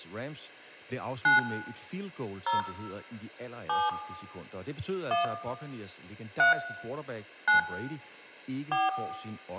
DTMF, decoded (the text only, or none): 9 0 7 1 3 9 4